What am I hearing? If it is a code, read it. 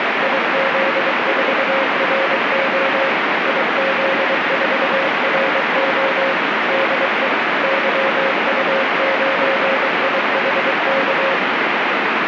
Morse code, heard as a keyed tone, machine-sent, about 23 wpm, 540 Hz, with heavy radio static. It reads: IZ4RO IZ4RO DE YU9IHK